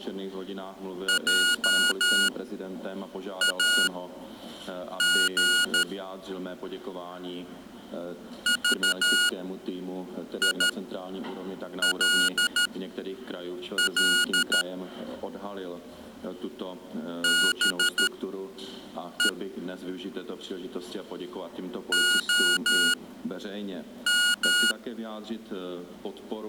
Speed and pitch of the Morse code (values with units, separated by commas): 13 wpm, spaced as for 6 wpm, 1440 Hz